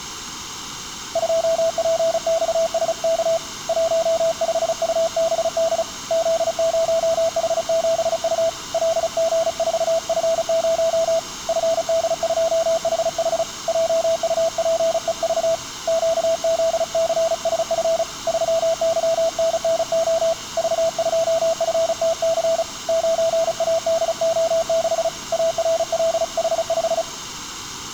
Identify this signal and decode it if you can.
Morse code, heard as a keyed tone, hand-sent with a paddle, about 35 wpm, 660 Hz, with room echo. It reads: 2PXSK 15UBD Z0H7U LG4F0 FD2HH JUPEV QZCSF 3YNNO V2FTC 9ADO6 ARLH5